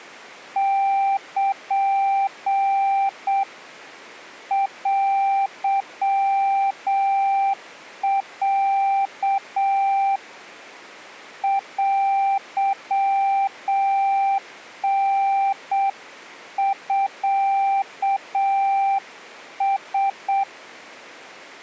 Morse code (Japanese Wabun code), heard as a keyed tone, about 7 wpm, 790 Hz. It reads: ル テロ テタミラ